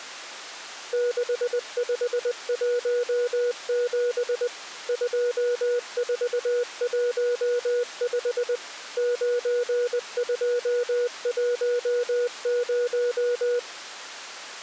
Morse code, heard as a keyed tone, machine-sent, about 20 wpm, 480 Hz. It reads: 6517 2415 9210